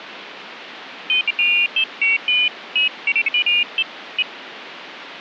Pairs of high tones at irregular times, with radio static. There is no code.